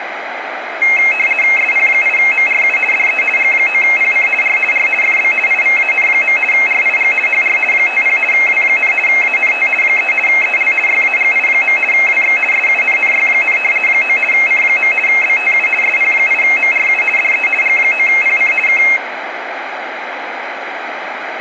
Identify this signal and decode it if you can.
RTTY (50 baud, 450 Hz shift), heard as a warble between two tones, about 2350 Hz centre, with radio static and room echo. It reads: SP8MRU DE G9PC R R FB IVAN. RIG HR 50 W, ANT 3 EL YAGI. WX SUNNY, 9 C. BTU SP8MRU DE G9PC K